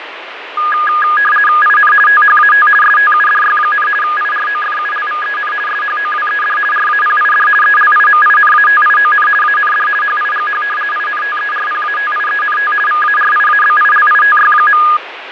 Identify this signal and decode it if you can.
RTTY (50 baud, 450 Hz shift), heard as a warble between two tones, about 1440 Hz centre, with radio static and fading. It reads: IN THAT STUDY, IROFULVEN SHOWED RAPID ELIMINATION AND HIGH INTERPATIENT VARIABILITY.